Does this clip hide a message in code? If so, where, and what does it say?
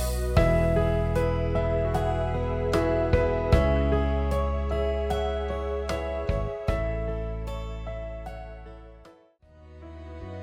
No.